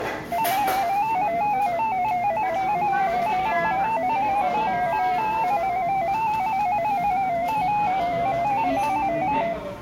Multi-tone FSK (Olivia or MFSK type), about 250 Hz wide, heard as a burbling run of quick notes, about 15.625 baud, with room echo and the noise of a cafe.